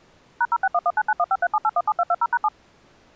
DTMF, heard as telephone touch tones, dialled by machine, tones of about 50 ms. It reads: #0611991537817220#7